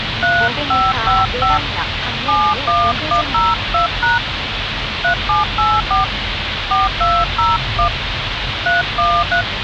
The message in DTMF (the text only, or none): 3555 71102# 3784 4201 313